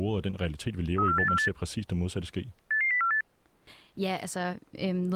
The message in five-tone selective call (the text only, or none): 34848 88048